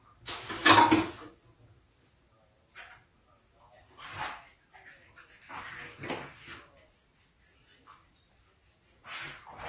The noise of a restroom. There is no code.